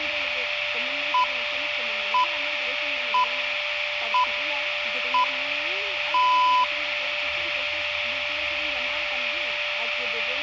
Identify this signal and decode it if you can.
Radio time signal (six pips, as the Greenwich Time Signal), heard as pips, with radio static, a steady whistle near 590 Hz and room echo.